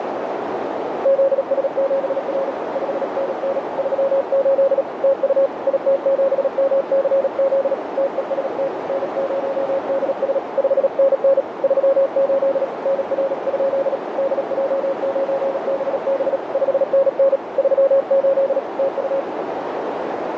Morse code, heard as a keyed tone, hand-sent with a paddle, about 37 wpm, 550 Hz, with heavy radio static and a narrow filter. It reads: ZS7R 5NN 38 TU IT7MCZ TEST N0DS 5NN 38 NR? DJ9BB 5NN 38 TU